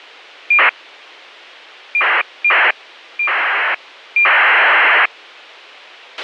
ACARS aircraft data, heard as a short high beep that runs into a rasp, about 2400 baud, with a squelch burst at the end.